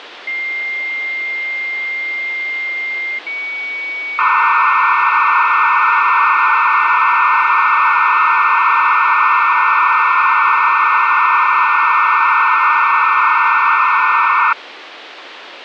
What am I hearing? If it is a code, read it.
Dial-up modem handshake (low-speed, two carriers), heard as two whistles, then hiss, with phone line noise.